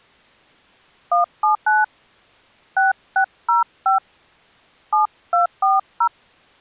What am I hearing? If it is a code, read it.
DTMF, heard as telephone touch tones, dialled by hand, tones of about 130 ms. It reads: 179 6605 7240